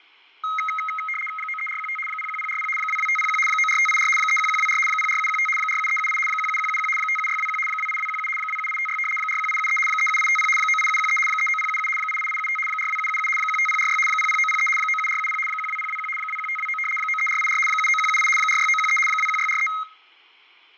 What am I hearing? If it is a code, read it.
RTTY (75 baud, 850 Hz shift), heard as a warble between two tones, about 1700 Hz centre, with fading. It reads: 93415 01040 22501 94584 31124 04715 47378 17171 57621 28217 27856 41873 37850 98713 39077 88875 42777 15046 00903 97470 12021 21529 93484 79178 46913 21643